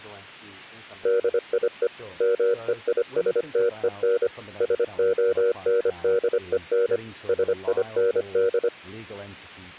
Morse code, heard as a keyed tone, machine-sent, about 25 wpm, 470 Hz, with speech in English. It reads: DIE MEISTEN SONDEN SIND